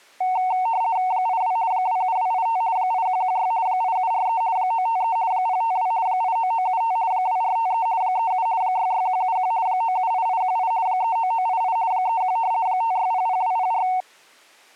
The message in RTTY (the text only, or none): 82 27285 8116 8743 953 052 89975 2453 37 66171 978818 39988 31 5600204